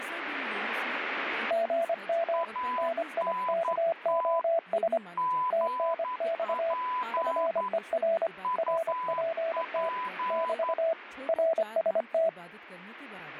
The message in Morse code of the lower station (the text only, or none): GM NIKOS TNX FER RPT <BT> RST